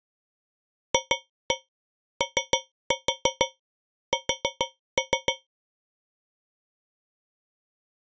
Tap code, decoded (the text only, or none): FOS